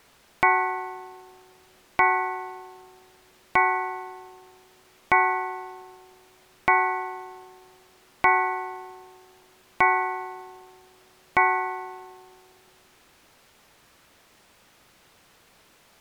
Clock strike, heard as a bell. 8. Eight o'clock.